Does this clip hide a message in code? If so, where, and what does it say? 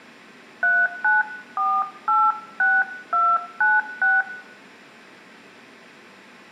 Yes: DTMF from 0.6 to 4.2 s, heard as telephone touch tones, dialled by hand, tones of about 230 ms, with room echo. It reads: 39486296